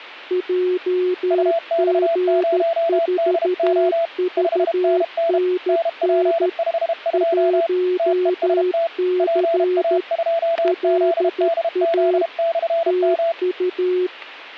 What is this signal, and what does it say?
Morse code, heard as two keyed tones, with static crashes. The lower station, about 13 wpm, 360 Hz: JG4VNN 1C LA TU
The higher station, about 32 wpm, 670 Hz: UX0DO 5NN NP52 TEST PA2ZDZ/M